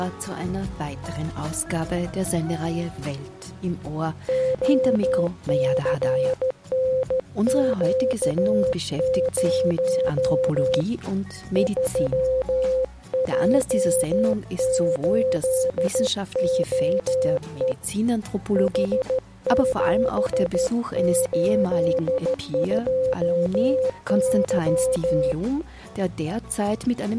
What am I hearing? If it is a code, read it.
Morse code, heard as a keyed tone, hand-sent with a straight key, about 13 wpm, 520 Hz. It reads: OCNQ0 3J8OE H782Y